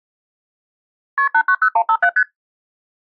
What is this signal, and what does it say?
Multi-frequency trunk signalling (R1, as on North American trunks), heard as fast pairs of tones, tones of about 70 ms. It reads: KP 890157 ST